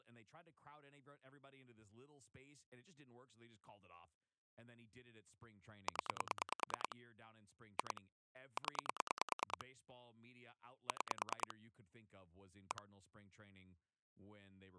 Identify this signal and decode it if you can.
Pulse dialling, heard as clicks on a phone line, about 9 pulses a second, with speech in English. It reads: 0 2 0 6 1